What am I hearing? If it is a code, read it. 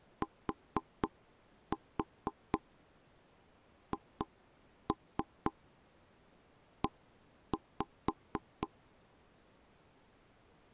Tap code, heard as taps on a table, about 4 knocks a second. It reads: THE